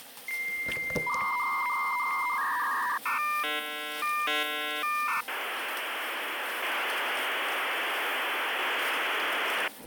Dial-up modem handshake (V.34 or later), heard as a whistle, warbles, then hiss, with the noise of a restroom.